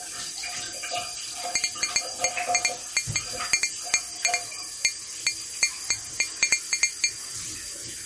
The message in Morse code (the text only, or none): none